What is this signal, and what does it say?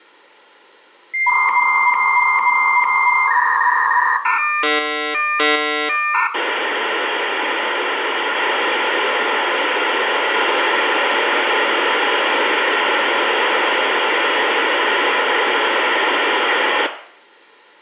Dial-up modem handshake (V.34 or later), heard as a whistle, warbles, then hiss, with room echo.